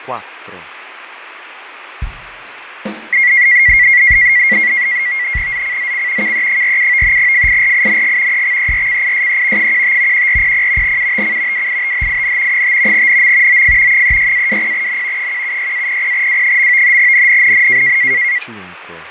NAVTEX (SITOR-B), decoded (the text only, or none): ZCZC KE47 FIRING EXERCISE 15 1400 UTC WITHIN 5 NM OF 36-20N 176-00W. NNNN